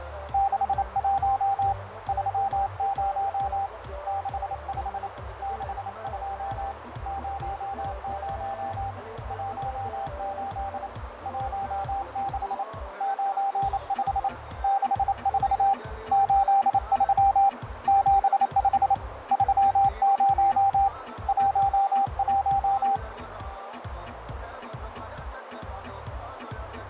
Morse code, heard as a keyed tone, hand-sent with a paddle, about 28 wpm, 790 Hz, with radio static, fading and a narrow filter. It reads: 61 30 65 62 00 18 16 95 64 83 75 30 11